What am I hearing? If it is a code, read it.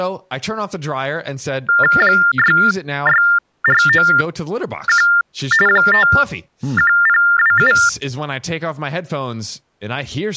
TTY/TDD text telephone tones (45.45 baud Baudot), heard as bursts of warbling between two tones, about 400 Hz shift, 1600 Hz centre, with speech in English. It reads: 66491 51027